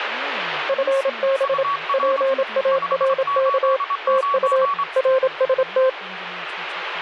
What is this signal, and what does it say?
Morse code, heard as two keyed tones, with radio static and speech in English. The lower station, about 27 wpm, 530 Hz: FB PARK TU RST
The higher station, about 25 wpm, 1130 Hz: UR 589